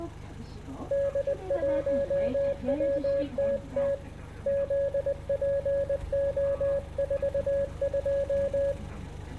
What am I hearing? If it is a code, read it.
Morse code, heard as a keyed tone, hand-sent with a paddle, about 20 wpm, 560 Hz, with the noise inside a bus. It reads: D1WTT ZPO42